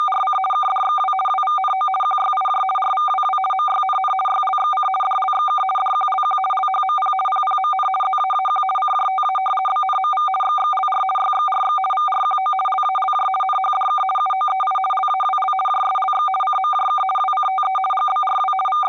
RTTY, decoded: … KDXW WVNO QYIJ RVWW MYNN YLXC DLXK DQLQ LHMP PPMN ZAAQ CJTA BNMV XXLR YXRX VRQO LALJ NHDK UOEI LAWL JSLX CMJK WCTE GBRW …

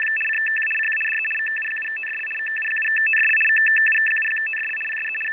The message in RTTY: … CQ CQ DE VU7TFL VU7TFL VU7TFL PSE …

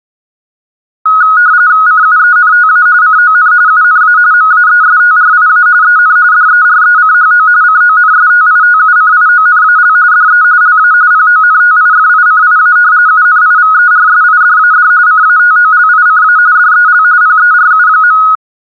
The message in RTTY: CUENTA CON UNA MAESTRIA EN DERECHO CONSTITUCIONAL DE LA PONTIFICIA UNIVERSIDAD CATOLICA DEL PERU.

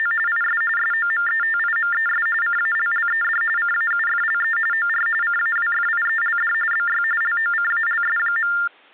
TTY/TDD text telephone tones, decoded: … IS SOMETIMES CALLED CAUFLE OR CAWFIELD BY LOCALS.

